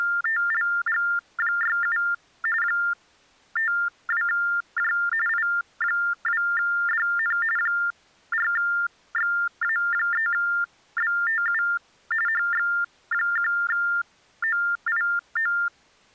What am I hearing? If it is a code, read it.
TTY/TDD text telephone tones (45.45 baud Baudot), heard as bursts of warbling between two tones, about 400 Hz shift, 1600 Hz centre. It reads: … 52J I2DN 4XA3BTU HX1OIO